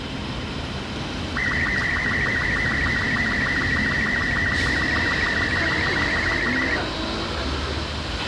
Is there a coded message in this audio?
Yes: SSTV (slow-scan television), Robot 36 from 1.4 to 6.8 s, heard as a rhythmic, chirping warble, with radio hiss, a squelch burst at the end, room echo and street noise.